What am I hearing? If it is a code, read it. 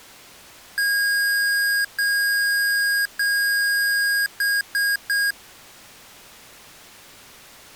Beep code, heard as beeps from a small speaker, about 1650 Hz. 3 long, 3 short.